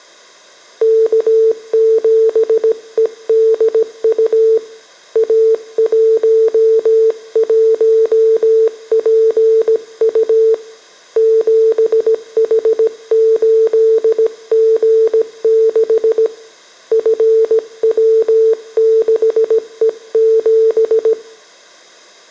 Morse code, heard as a keyed tone, hand-sent with a paddle, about 17 wpm, 450 Hz, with room echo. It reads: K7EDU A11PU 7H8G6 FW6E7